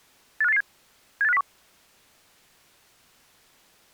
Five-tone selective call (EEA), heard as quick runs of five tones, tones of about 40 ms. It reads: 85887 78501